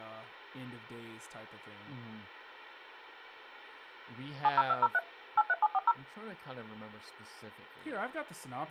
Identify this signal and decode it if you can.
DTMF, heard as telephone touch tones, dialled by machine, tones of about 40 ms, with hum and speech in English. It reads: 70203 83740